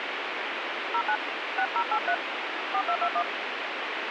DTMF, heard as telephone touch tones, dialled by hand, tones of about 70 ms, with radio hiss. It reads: 09 6083 4221